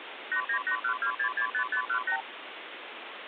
Multi-frequency trunk signalling (R2, with the far end's replies), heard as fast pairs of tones, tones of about 90 ms, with phone line noise. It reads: 89812665518